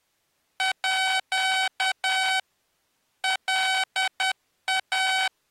Morse code (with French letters), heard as electronic beeps, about 10 wpm, 760 Hz. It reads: À LA